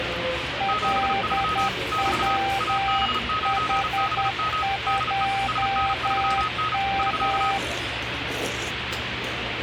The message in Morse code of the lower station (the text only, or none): LWH2M